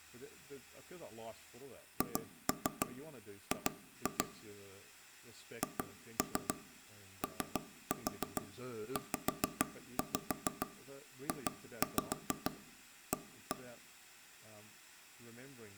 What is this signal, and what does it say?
Tap code, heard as taps on a table, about 6 knocks a second, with room echo and speech in English. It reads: HG HOZJA